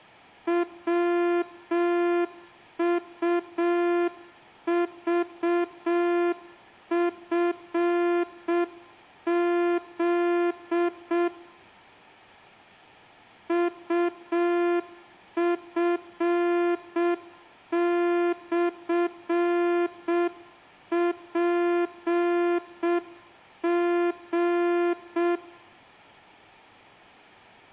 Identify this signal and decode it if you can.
Morse code, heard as a horn, hand-sent with a straight key, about 6 wpm. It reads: WUVFZ UF/PG